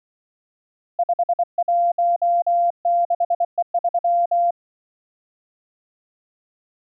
Morse code, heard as a keyed tone, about 24 wpm, 690 Hz. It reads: 516E3